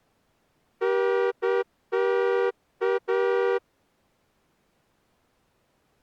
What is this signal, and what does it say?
Morse code, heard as a horn, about 9 wpm. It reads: NTA